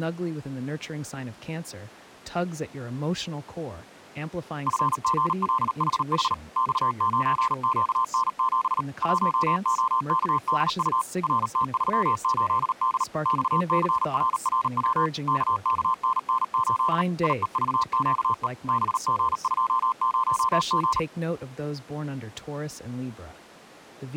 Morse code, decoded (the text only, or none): FGLHH X9QN7 1OKDU RT38D XCRRW KKNN8 IEVQE BG20G